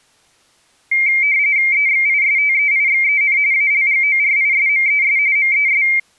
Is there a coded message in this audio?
Yes: RTTY (45.45 baud, 170 Hz shift) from 0.9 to 6.0 s, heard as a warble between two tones, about 2200 Hz centre. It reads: EXISTEIXEN ALGORISMES MES